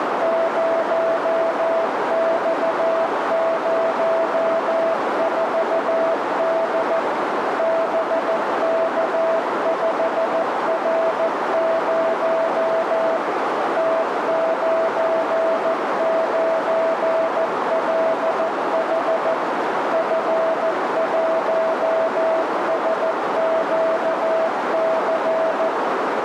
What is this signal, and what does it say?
Morse code, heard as a keyed tone, machine-sent, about 14 wpm, 660 Hz, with heavy radio static and a narrow filter. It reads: 0X04D BK5R0 T99LH F1SQC